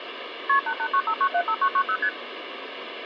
Multi-frequency trunk signalling (R1, as on North American trunks), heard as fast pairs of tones, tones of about 70 ms, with phone line noise. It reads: KP 8895975990 ST